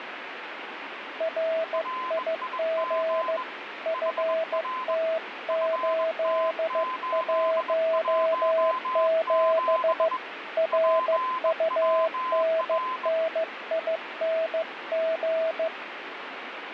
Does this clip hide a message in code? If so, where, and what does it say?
Yes: Morse code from 1.1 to 15.7 s, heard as two keyed tones, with radio static. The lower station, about 15 wpm, 650 Hz: RIG FT817 RUNNING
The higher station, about 21 wpm, 1030 Hz: RIG HR FT817 PWR